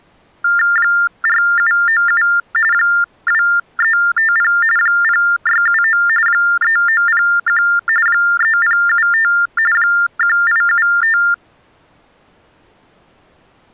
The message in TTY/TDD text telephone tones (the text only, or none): 4797 2350 0679 3901 3075 1875